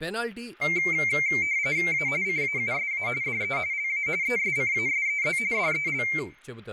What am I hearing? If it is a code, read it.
RTTY (45.45 baud, 170 Hz shift), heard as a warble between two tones, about 2200 Hz centre, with room echo and speech in Telugu. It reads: A CAUSA DE LA ESCASEZ DEL